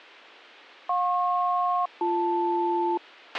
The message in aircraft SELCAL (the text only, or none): JP-BL